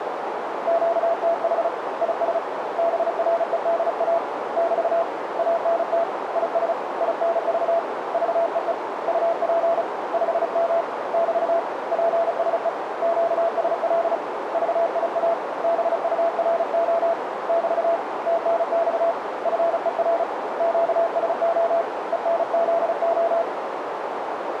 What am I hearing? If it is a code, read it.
Morse code, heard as a keyed tone, hand-sent with a paddle, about 35 wpm, 670 Hz, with radio static and a narrow filter. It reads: QTH IS BREDA <BT> ANT IS INV VEE UP 5M <BT> PSE QSL VIA BURO <BT> TNX FER QSO ENZO